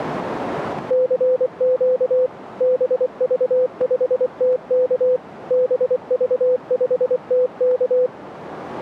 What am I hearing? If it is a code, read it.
Morse code, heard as a keyed tone, machine-sent, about 24 wpm, 510 Hz, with radio static. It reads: CQ BV5TK BV5TK